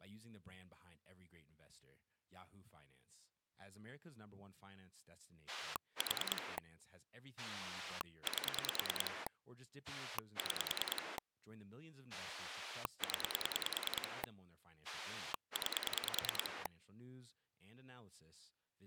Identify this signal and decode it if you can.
Pulse dialling, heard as a rotary dial, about 10 pulses a second, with speech in English. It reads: 4 8 6 0 9